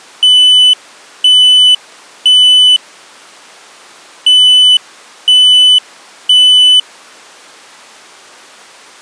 Alarm pattern, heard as an alarm's beeps, played twice, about 3000 Hz. Temporal three. Smoke or fire, evacuate.